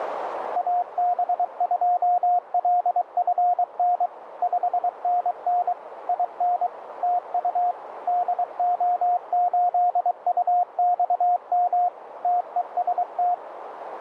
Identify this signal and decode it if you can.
Morse code, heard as a keyed tone, machine-sent, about 23 wpm, 710 Hz, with radio static and a narrow filter. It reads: AB2LFN 5NN IN TU DO8UXM TEST